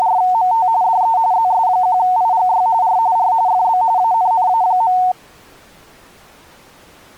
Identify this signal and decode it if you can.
RTTY (45.45 baud, 170 Hz shift), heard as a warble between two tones, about 820 Hz centre. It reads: … DE ZS1IGY R R FB ANNA.